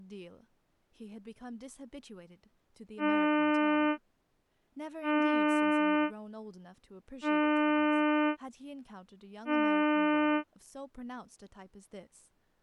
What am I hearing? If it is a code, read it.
Ship horn signal, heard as a ship's horn, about 300 Hz, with speech in English. 4 short. At sea: a pilot vessel's identity signal in fog.